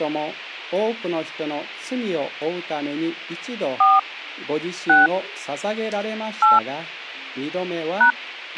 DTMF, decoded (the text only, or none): 4 6 8 #